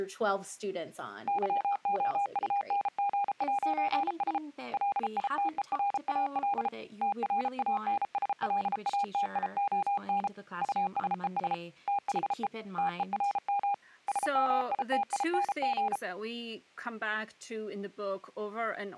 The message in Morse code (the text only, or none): YOUNG'S LITERAL TRANSLATION USES THE TERM SMITING